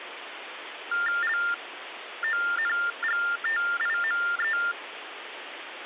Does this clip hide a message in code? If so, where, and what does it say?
Yes: TTY/TDD text telephone tones (45.45 baud Baudot) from 0.9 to 4.7 s, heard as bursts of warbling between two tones, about 400 Hz shift, 1600 Hz centre, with phone line noise. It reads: LONGTIME